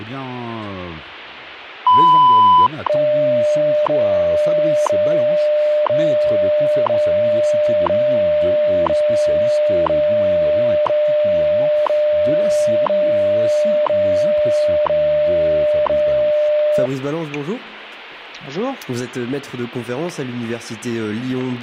Radio time signal (WWV, Colorado), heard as ticks, one a second.